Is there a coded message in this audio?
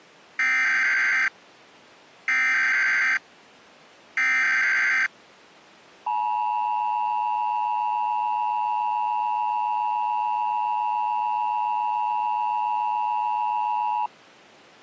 Yes: Emergency Alert System (SAME) tones (header bursts, then the 853 and 960 Hz attention tone) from 0.4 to 14.1 s, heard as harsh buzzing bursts, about 520.83 baud.